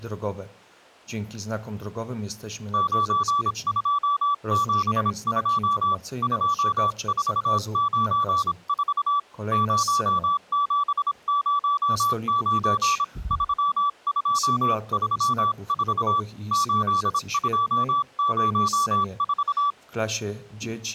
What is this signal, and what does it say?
Morse code, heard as a keyed tone, hand-sent with a paddle, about 26 wpm, 1150 Hz. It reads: 9272 2494 0709 3234 8204